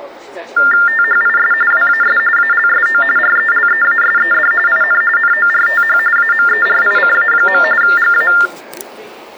TTY/TDD text telephone tones (45.45 baud Baudot), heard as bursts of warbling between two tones, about 400 Hz shift, 1600 Hz centre, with the noise of a crowd indoors. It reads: THIS WAS ALSO RELEASED IN NORTH AMERICA. GA